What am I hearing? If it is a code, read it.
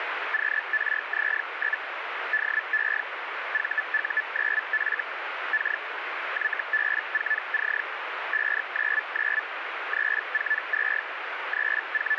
Hellschreiber (Feld-Hell, 122.5 baud), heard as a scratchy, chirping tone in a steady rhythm, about 1750 Hz, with radio static. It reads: QRZ? DE VU9F K YB4C 599 342 …